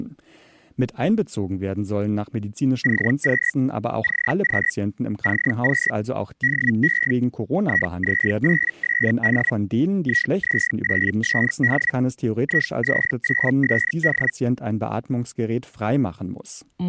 Hellschreiber (Feld-Hell, 122.5 baud), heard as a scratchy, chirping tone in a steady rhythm, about 1900 Hz, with speech in German. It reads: CQ CQ CQ DE IZ8SD IZ8SD IZ8SD